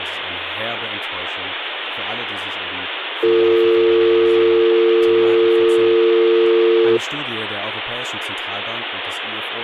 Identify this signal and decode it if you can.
Telephone call progress tone (North American or UK plan), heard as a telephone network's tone, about 350, 450 Hz, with phone line noise and speech in German. Dial tone.